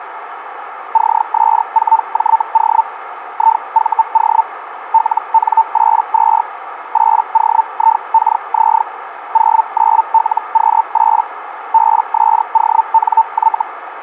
Hellschreiber (Feld-Hell, 122.5 baud), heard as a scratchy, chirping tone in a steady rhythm, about 900 Hz, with radio static and a narrow filter. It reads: CS4JO IVO LN82 8OIKZ 09LQ8 BSONY